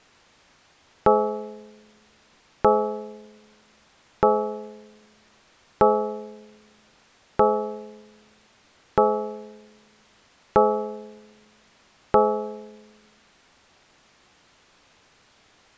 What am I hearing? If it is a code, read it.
Clock strike, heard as a bell. 8. Eight o'clock.